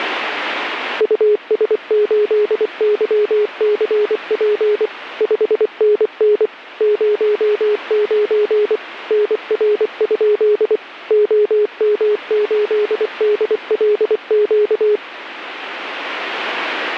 Morse code, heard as a keyed tone, machine-sent, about 24 wpm, 420 Hz, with radio static. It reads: US8YCP 5NN 09 NR? OM8DLQ